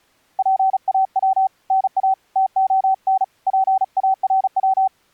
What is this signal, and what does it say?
Morse code (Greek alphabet), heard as a keyed tone, hand-sent with a paddle, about 36 wpm, 770 Hz. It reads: ΠΑΩ ΝΑ ΤΟΝ ΠΑΡΩ